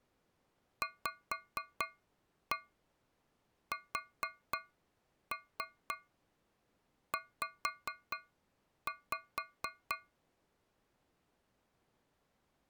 Tap code, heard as taps on a metal pipe, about 4 knocks a second. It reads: VSZ